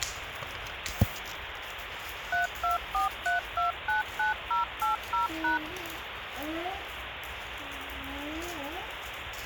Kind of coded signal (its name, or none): DTMF